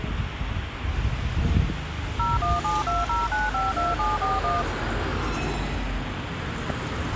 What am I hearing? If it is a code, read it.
DTMF, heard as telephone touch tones, dialled by machine, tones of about 180 ms, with phone line noise and street noise. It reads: 01720952741